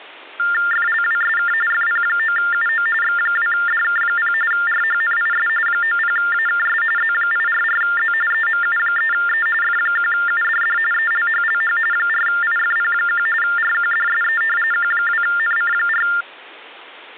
TTY/TDD text telephone tones (45.45 baud Baudot), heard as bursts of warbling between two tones, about 400 Hz shift, 1600 Hz centre. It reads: FLWSK FP9UO X2DK0 RHNIS 90AKS Z844Z EMU3E F1UDD ELHLH 4IFP1 RQDSE Q2NC4